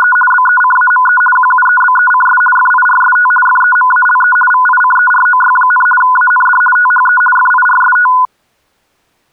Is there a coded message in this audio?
Yes: RTTY (50 baud, 450 Hz shift) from 0.0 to 8.3 s, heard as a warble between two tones, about 1240 Hz centre. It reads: … BECAME QUEBECS FIRST FEMALE VICEROY, AND THE FIRST